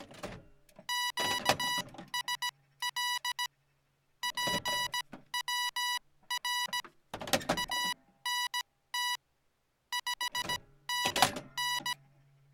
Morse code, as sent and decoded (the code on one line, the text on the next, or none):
--.- ... .-.. / .--. .-- .-. / .- -. - / ..... -. -.
QSL PWR ANT 5NN